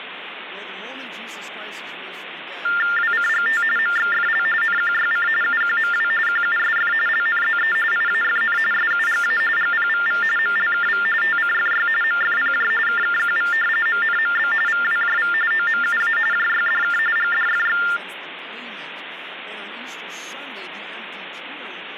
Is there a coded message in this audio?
Yes: TTY/TDD text telephone tones (45.45 baud Baudot) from 2.6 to 18.0 s, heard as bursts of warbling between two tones, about 400 Hz shift, 1600 Hz centre, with phone line noise. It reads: WCGT MXFL NQYC UQMW QUSF LNZE IAFN SUGA GPVV MLKV TCFY MFPJ KKQV MNMB VWJV OMUA JYDK GDFX